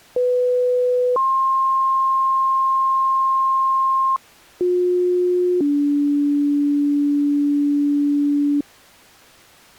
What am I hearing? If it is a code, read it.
Two-tone page, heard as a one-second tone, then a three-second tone, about 500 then 1060 Hz, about 360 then 290 Hz.